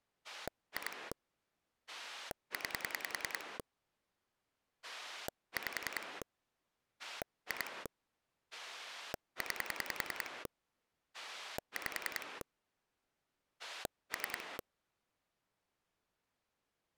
Pulse dialling, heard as a rotary dial, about 10 pulses a second. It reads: 2 9 5 2 9 5 3